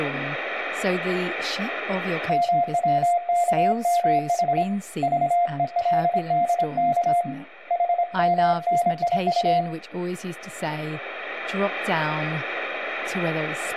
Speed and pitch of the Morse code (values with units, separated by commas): 26 wpm, 700 Hz